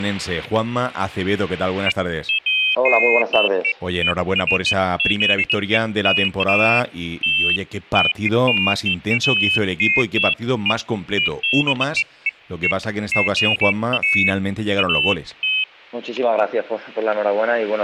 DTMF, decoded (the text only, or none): none